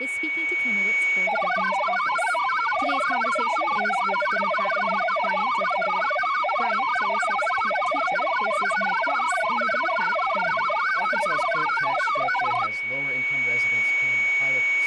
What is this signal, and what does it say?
Multi-tone FSK (Olivia or MFSK type), about 1000 Hz wide, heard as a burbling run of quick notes, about 62.5 baud, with a steady whistle near 2240 Hz.